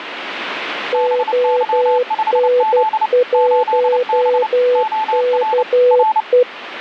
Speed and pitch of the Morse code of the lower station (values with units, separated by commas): 12 wpm, 500 Hz